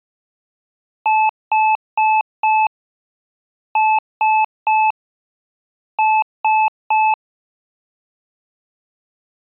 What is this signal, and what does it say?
Beep code, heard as beeps from a small speaker, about 870 Hz. 4-3-3. In Phoenix BIOS tables: timer channel 2 failure.